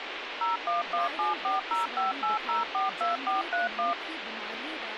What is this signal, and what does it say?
DTMF, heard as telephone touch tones, dialled by machine, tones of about 150 ms, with phone line noise and speech in Dogri. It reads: 01174058042431